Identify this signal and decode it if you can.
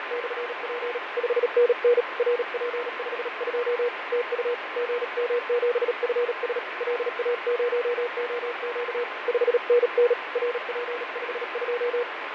Morse code, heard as a keyed tone, hand-sent with a paddle, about 37 wpm, 480 Hz, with radio static and fading. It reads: … 5NN RP52 TU GM7FS LA0OQ 5NN RP52